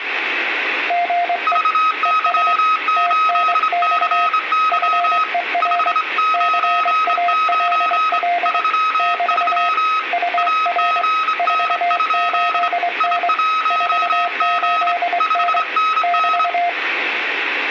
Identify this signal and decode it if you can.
Morse code, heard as two keyed tones, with radio static and room echo. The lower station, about 23 wpm, 700 Hz: GE ES TNX FER CALL <BT> UR 48N 48N <BT>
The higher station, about 26 wpm, 1270 Hz: VY8CY 599 33 AGN? I1G 5NN